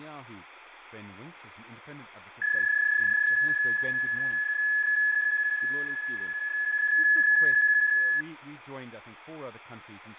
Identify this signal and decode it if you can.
PSK31 (31.25 baud), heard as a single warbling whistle, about 1700 Hz, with fading and speech in English.